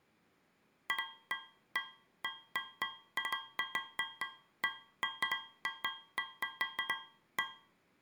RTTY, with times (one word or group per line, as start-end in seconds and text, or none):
none